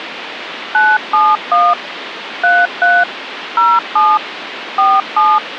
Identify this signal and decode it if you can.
DTMF, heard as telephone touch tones, dialled by machine, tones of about 220 ms, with phone line noise. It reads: 971 33 07 47